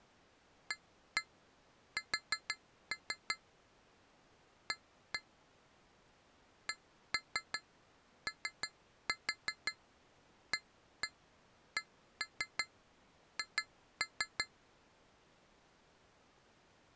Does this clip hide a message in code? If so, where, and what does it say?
Yes: tap code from 0.7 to 14.5 s, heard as taps on glass, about 5 knocks a second. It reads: AS A COACH